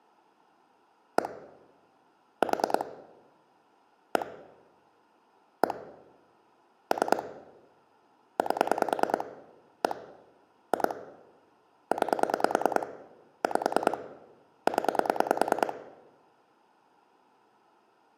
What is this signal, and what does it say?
Pulse dialling, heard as clicks on a phone line, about 9 pulses a second, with room echo. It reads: 1 4 1 1 3 8 1 2 9 5 0